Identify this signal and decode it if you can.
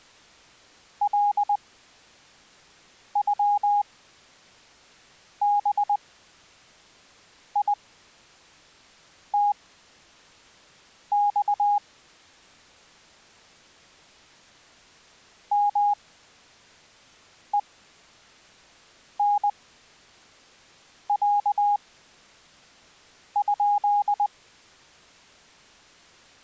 Morse code (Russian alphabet), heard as a keyed tone, machine-sent, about 20 wpm, spaced as for 5 wpm, 820 Hz. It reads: ЛЮБИТЬ МЕНЯ?